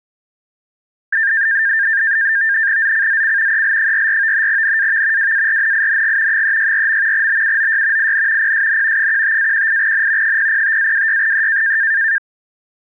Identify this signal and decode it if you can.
NAVTEX (SITOR-B), 100 baud, 170 Hz shift, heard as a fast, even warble, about 1700 Hz centre. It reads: ZCZC EL44 NAV WARNING 364. BUOY IN PSN 15-18N 005-26E